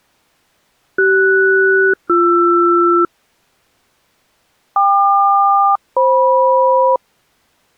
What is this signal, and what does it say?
Aircraft SELCAL, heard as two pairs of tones. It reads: CS-BR KQ-FM